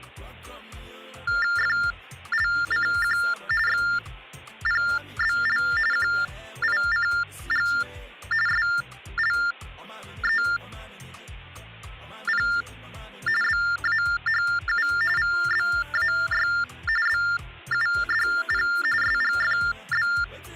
TTY/TDD text telephone tones (45.45 baud Baudot), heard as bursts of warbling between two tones, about 400 Hz shift, 1600 Hz centre, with hum. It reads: FLCQ XPBL QICG SLEP BAHU VBAY BUDP SGFB